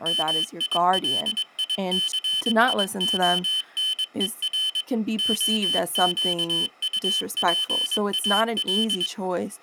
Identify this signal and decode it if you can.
Morse code (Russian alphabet), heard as a high beeper, machine-sent, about 22 wpm, 3050 Hz, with speech in English. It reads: МИЛИЦИОНЕР ОЩУПАЛ